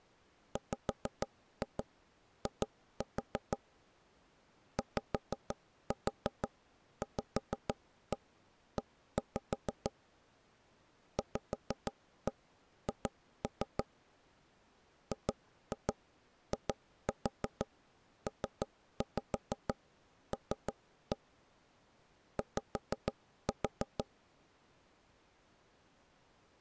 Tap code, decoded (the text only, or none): WI YVE VH GIPL Y